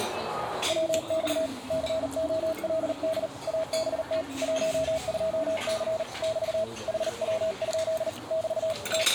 Morse code, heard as a keyed tone, hand-sent with a paddle, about 39 wpm, 640 Hz, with radio static, a narrow filter and the noise of a restaurant. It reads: WX COLD ABT 12C <BT> HW? <BT> …